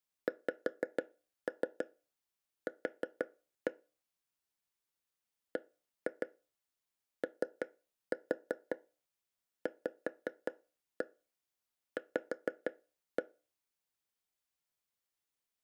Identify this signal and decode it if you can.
Tap code, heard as taps on a table, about 6 knocks a second. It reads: XQ BOVV